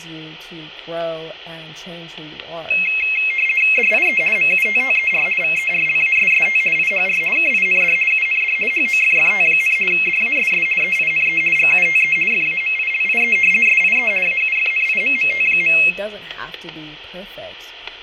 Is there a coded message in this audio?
Yes: RTTY (50 baud, 450 Hz shift) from 2.7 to 15.9 s, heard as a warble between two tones, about 2350 Hz centre, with static crashes, room echo and speech in English. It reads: DIE MUTTER VERLASST IHR KIND UND HOFFT, DASS EINE GUTE FAMILIE SIE AUFNIMMT.